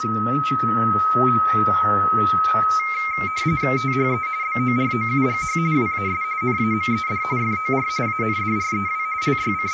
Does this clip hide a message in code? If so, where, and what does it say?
Yes: RTTY (45.45 baud, 170 Hz shift) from 2.8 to 9.7 s, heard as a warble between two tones, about 2200 Hz centre, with a steady whistle near 1280 Hz and room echo. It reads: THE BOROUGH WAS NAMED FOR ANDREW …